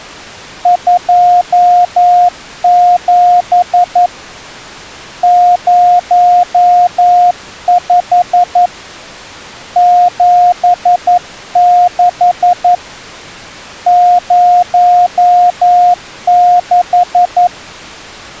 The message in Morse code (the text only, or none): 27 05 76 06